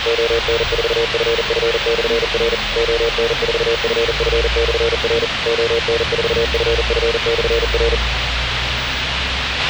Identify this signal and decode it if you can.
Morse code, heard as a keyed tone, machine-sent, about 40 wpm, 460 Hz, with radio hiss, a squelch burst at the end and the noise inside a bus. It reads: ON4FF/R ON4FF/R ON4FF/R